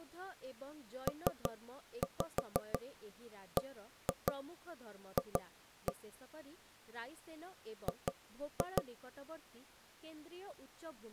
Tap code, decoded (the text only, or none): PBF G